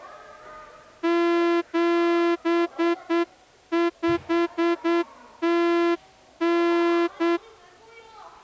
Morse code (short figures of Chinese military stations), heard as a horn, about 8 wpm, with the noise of a crowd indoors. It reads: 7509